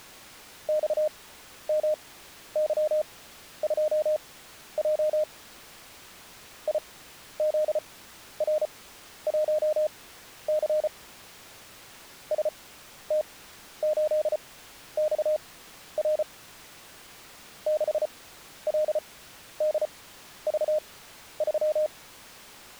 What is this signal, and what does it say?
Morse code, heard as a keyed tone, machine-sent, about 34 wpm, spaced as for 12 wpm, 610 Hz. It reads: XMY2J IZR1C ST8XR 6LDV3